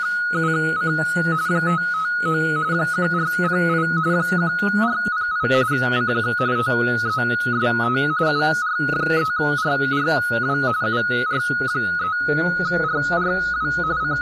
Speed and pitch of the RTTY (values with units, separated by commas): 45.45 baud, 170 Hz shift, 1360 Hz centre